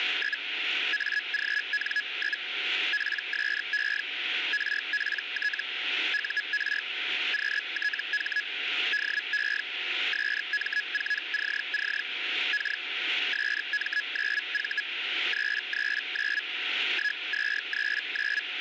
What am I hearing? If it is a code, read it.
Hellschreiber (Feld-Hell, 122.5 baud), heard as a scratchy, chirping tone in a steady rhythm, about 1700 Hz, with radio static and a steady whistle near 740 Hz. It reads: … AGN? PSE RPT UR QTH DE SM4CC K SM9V 339 1239